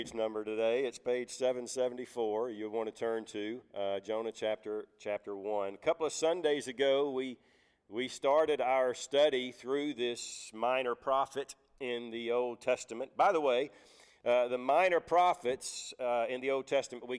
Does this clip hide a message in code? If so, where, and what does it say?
No.